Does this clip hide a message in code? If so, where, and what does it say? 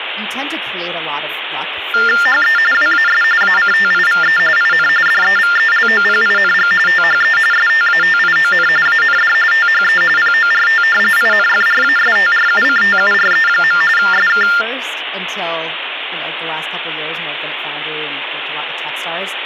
Yes: TTY/TDD text telephone tones (45.45 baud Baudot) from 1.9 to 14.6 s, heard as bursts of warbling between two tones, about 400 Hz shift, 1600 Hz centre, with phone line noise and speech in English. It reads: HE WAS ACTIVE IN DEVELOPING THE STATION AND THE PORT INFRASTRUCTURE. SK